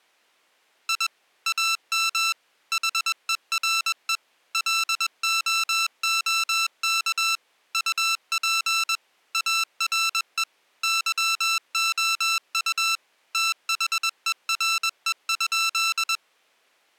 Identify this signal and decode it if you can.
Morse code, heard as electronic beeps, machine-sent, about 21 wpm, 1340 Hz. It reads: I AM HERE LOOK UP ARE YOU THERE?